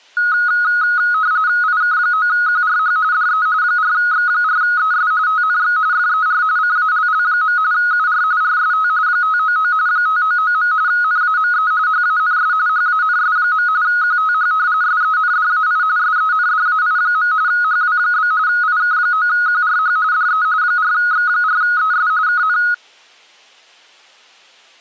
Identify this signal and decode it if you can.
RTTY (45.45 baud, 170 Hz shift), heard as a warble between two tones, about 1360 Hz centre. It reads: IK9QRH DE 4X4ES TNX FER CALL. UR RST 599 599. NAME HANS HANS. QTH SENDAI SENDAI. HW? IK9QRH DE 4X4ES KN